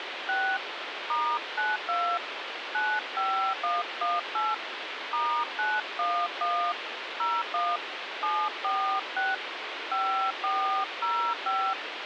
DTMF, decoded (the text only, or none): 6 *92 95118 *911 01 746 5405